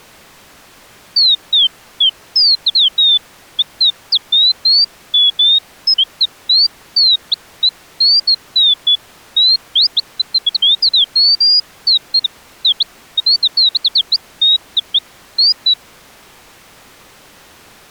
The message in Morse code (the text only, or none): none